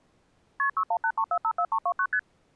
Multi-frequency trunk signalling (R1, as on North American trunks), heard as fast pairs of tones, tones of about 70 ms. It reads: KP 6183454329 ST